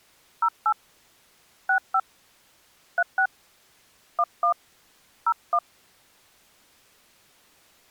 DTMF, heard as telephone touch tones, dialled by hand, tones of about 70 ms. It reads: 08 65 36 11 01